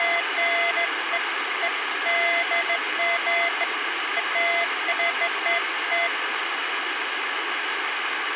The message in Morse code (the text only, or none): none